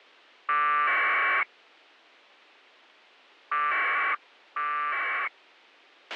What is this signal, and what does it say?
Packet radio (AX.25, as in APRS), 1200 baud, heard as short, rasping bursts, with a squelch burst at the end.